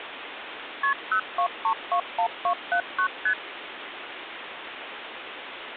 Multi-frequency trunk signalling (R1, as on North American trunks), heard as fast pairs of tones, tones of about 80 ms, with phone line noise. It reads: KP 02321279 ST